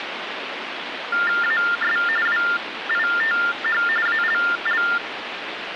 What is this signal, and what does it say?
TTY/TDD text telephone tones (45.45 baud Baudot), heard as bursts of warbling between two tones, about 400 Hz shift, 1600 Hz centre, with phone line noise. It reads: AS WITH ALL